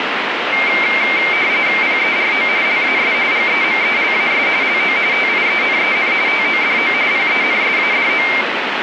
RTTY (45.45 baud, 170 Hz shift), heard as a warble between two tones, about 2200 Hz centre, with radio static. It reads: PERO LAS GEMELAS LO TIENEN TODO PENSADO